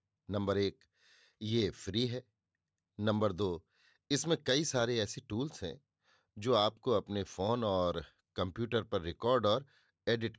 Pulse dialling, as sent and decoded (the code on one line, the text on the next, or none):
none